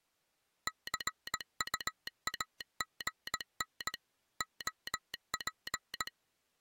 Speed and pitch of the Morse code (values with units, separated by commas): 18 wpm